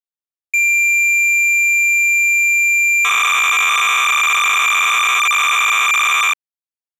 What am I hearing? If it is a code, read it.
Cassette data (Kansas City type), 300 baud, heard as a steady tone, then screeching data.